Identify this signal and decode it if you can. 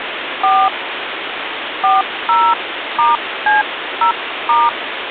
DTMF, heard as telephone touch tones, dialled by hand, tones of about 180 ms, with phone line noise. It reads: 4 40*C0*